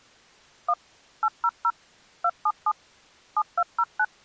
DTMF, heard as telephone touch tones, dialled by machine, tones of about 60 ms. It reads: 1 800 277 7209